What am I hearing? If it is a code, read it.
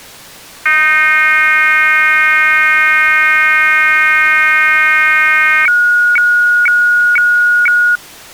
Weather fax (radiofax), 120 lines a minute, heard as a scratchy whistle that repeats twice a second.